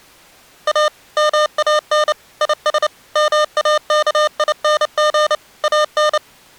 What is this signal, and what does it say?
Morse code, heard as electronic beeps, machine-sent, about 29 wpm, 610 Hz. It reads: A MAN IS MAKING AN